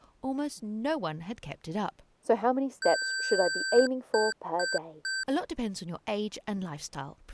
Beep code, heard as beeps from a small speaker, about 1550 Hz, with speech in English. 1 long, 3 short. In Award and IBM BIOS tables: video adapter failure; in AMI BIOS tables: memory failure.